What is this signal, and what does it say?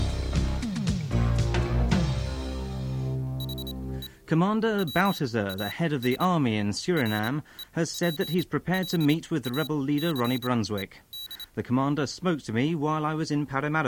Morse code, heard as a high beeper, machine-sent, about 27 wpm, spaced as for 18 wpm, 3900 Hz. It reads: HE WAS REPLACED